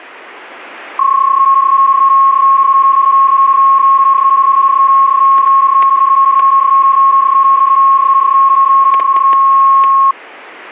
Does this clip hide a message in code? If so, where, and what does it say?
Yes: PSK31 (31.25 baud) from 1.0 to 10.1 s, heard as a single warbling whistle, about 1090 Hz, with static crashes.